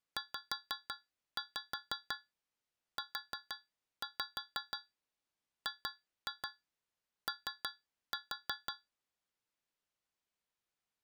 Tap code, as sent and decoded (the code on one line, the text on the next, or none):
5-5 4-5 2-2 3-4
ZUGO